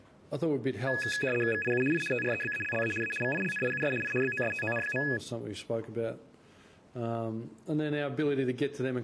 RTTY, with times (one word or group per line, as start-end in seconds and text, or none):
1.5-1.8 VIU
1.9-2.0 I
2.1-2.9 TREBALLA
3.0-3.1 A
3.2-3.9 VILNIUS
4.0-4.1 I
4.2-5.0 BOSTON.